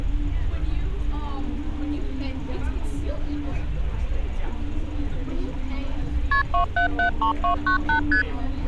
Multi-frequency trunk signalling (R1, as on North American trunks), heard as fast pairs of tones, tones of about 100 ms, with street noise. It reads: KP 2773298 ST